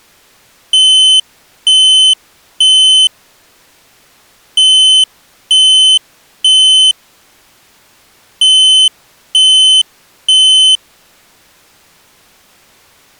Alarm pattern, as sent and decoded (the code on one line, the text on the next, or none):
3 beeps and a pause
temporal three